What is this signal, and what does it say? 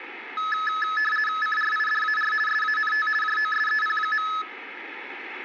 RTTY (50 baud, 450 Hz shift), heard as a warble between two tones, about 1500 Hz centre, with radio static. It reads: CRIDAR SANT JOSEP.